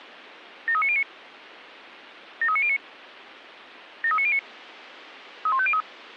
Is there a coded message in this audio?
Yes: five-tone selective call (ZVEI) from 0.7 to 5.8 s, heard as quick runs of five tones, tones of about 70 ms. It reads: 73909 73909 73909 31503